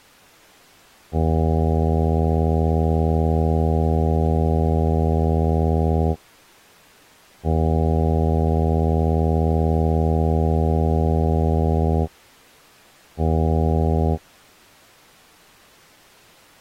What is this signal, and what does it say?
Ship horn signal, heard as a ship's horn, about 80 Hz. 2 long, 1 short. At sea: I intend to overtake on your starboard side.